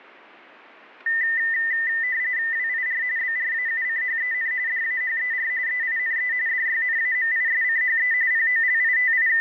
RTTY (45.45 baud, 170 Hz shift), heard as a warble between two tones, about 1900 Hz centre. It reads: WIR BRAUCHEN DAHER EINE DYNAMISCHE …